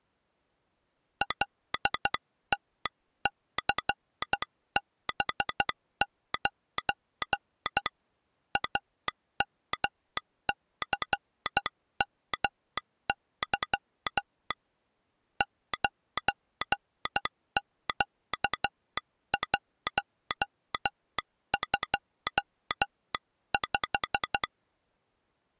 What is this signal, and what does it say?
Morse code, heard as a telegraph sounder, hand-sent with a paddle, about 12 wpm. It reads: LTCB9 AMCMY 9Q125